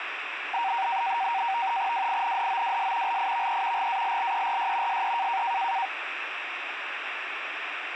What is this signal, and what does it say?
NAVTEX (SITOR-B), 100 baud, 170 Hz shift, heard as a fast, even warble, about 860 Hz centre, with radio static. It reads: WINDOWS LIVE GALLERY SE